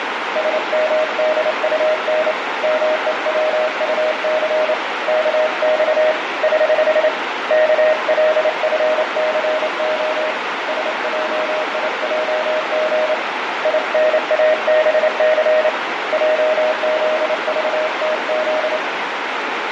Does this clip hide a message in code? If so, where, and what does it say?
Yes: Morse code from 0.3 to 18.8 s, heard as a keyed tone, hand-sent with a straight key, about 28 wpm, 620 Hz, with heavy radio static, fading and a narrow filter. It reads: SMDUN MEWUC KX <HH> KLFCO SJIJG INABC JZVTZ